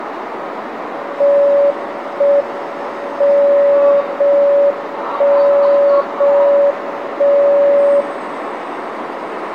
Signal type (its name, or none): radio time signal